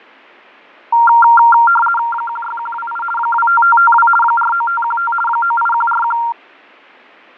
RTTY (50 baud, 450 Hz shift), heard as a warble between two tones, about 1160 Hz centre, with fading. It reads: 16128 25552 49515 98141